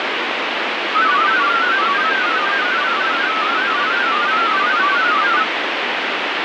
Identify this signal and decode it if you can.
Multi-tone FSK (Olivia or MFSK type), about 500 Hz wide, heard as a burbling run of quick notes, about 31.25 baud, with heavy radio static.